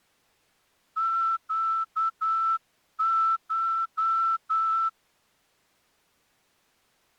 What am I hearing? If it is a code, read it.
Morse code (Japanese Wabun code), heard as a whistle, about 9 wpm. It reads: ネコ